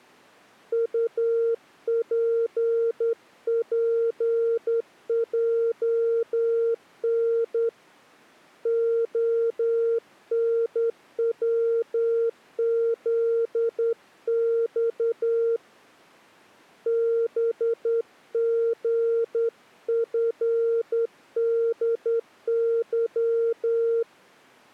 Morse code, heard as a keyed tone, hand-sent with a straight key, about 10 wpm, 460 Hz. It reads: UPPJN ONWZX BGFDY